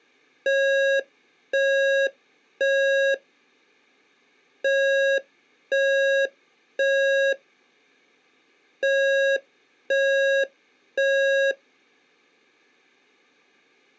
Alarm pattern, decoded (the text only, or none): temporal three